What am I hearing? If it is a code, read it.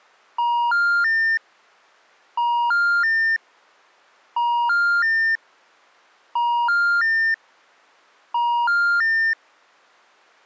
Telephone call progress tone (ITU plan), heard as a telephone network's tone, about 950, 1400, 1800 Hz. Special information tone.